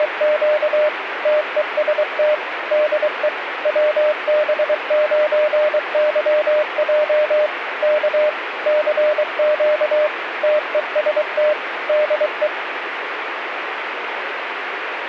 Morse code, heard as a keyed tone, machine-sent, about 23 wpm, 600 Hz, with radio static. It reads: … TEST DE WB9YJ K CQ TEST DE